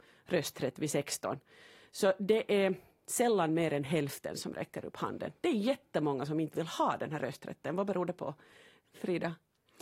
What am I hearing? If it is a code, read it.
Speech in Swedish. There is no code.